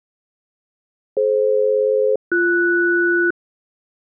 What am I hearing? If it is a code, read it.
Aircraft SELCAL, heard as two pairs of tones. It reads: DF-BS